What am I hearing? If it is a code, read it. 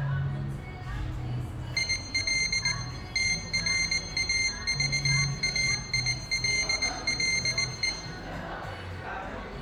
Morse code, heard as a high beeper, machine-sent, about 19 wpm, 2100 Hz, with room echo and the noise of a cafe. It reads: IL TRAVAILLE